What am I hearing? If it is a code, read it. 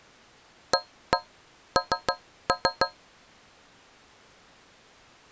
Tap code, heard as taps on a metal pipe, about 6 knocks a second. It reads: AN